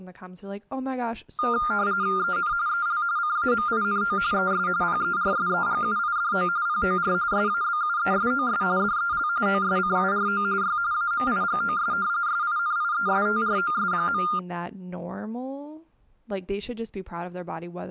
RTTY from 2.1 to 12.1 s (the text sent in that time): EN EL CAMINO ES PERSEGUIDO POR SABUESOS DEL OSCURO Y AMIGOS